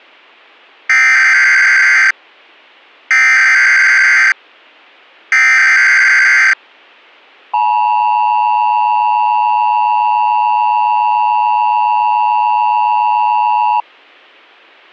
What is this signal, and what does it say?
Emergency Alert System (SAME) tones (header bursts, then the 853 and 960 Hz attention tone), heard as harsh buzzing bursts, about 520.83 baud.